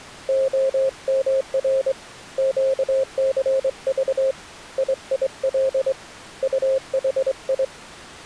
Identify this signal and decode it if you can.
Morse code, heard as a keyed tone, hand-sent with a straight key, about 23 wpm, 530 Hz. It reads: OMR QCV IIL UHI